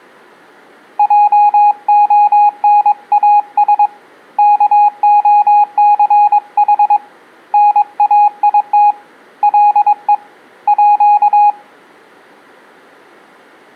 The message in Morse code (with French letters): JONAS KOCH NAIT LE À

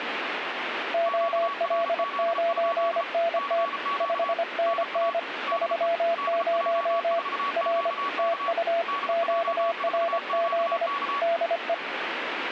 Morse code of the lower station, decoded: OL9NT 5NN 30 R TU QRZ DE

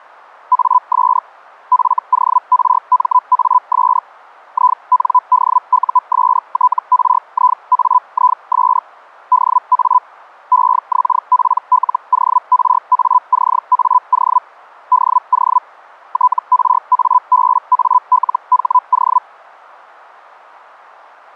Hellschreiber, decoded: AS FORMAS INDUSTRIAIS DA EXPLORACAO DO TRABALHO

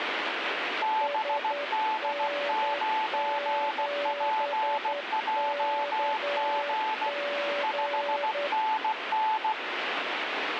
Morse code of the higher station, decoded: BD9PJG 5NN

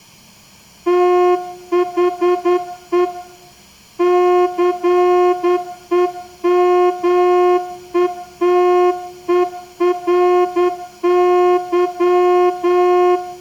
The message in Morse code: THE CEMETERY

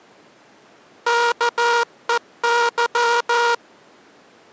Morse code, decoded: KEY

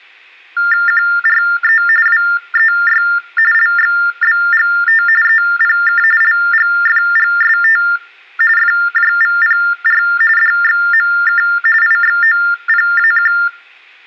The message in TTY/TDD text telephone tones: QRE WEY LXBGT EPK LGFGST FJVPR DXMK IXOPAQ

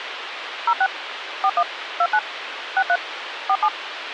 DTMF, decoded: 06 41 29 63 47

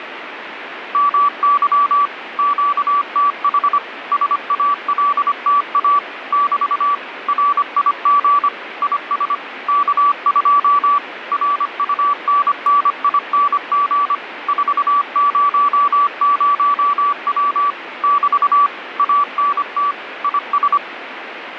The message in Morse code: MY QTH SALTA <BT> RIG IS K2 RUNNING 400W <BT> ANT IS

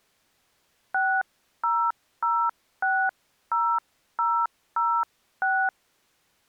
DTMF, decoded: 60060006

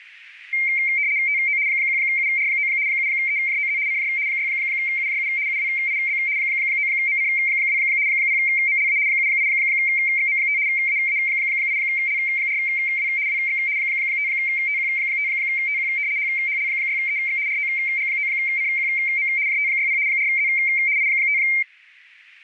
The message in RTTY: TO 1UR9 7EJOZ CJ 6UJU UWIB 9MC2 0MLA 78XM5 AA8L4W WX 5TQ5TQ HHL6EX ROG9CQM JT60 4Z I5

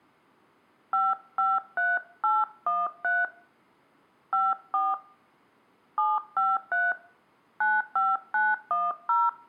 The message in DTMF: 553813 54 753 95910

